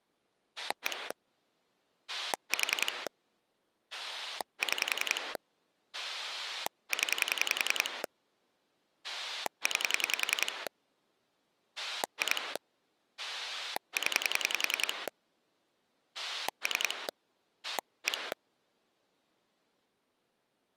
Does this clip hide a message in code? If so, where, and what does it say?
Yes: pulse dialling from 0.6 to 18.3 s, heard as a rotary dial, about 10 pulses a second. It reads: 1 4 6 0 9 2 0 3 1